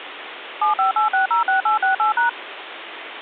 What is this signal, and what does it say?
DTMF, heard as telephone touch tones, dialled by machine, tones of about 130 ms, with phone line noise. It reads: 758606868#